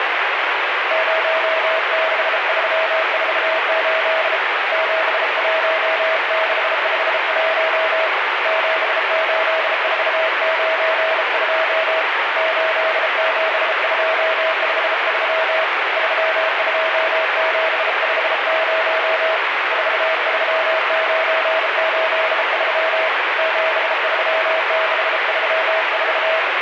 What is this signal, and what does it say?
Morse code, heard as a keyed tone, hand-sent with a bug key, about 33 wpm, 640 Hz, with heavy radio static. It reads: 06348 71651 78492 87253 32750 43983 73634